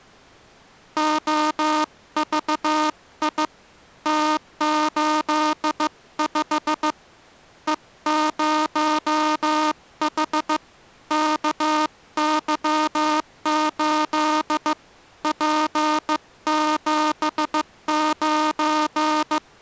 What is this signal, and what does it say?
Morse code, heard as a buzzer, hand-sent with a bug key, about 15 wpm. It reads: OVI T85 E0H KY8 P79